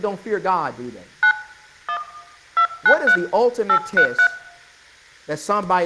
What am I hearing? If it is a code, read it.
DTMF, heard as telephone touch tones, dialled by hand, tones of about 80 ms, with room echo and speech in English. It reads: 9 1 293 833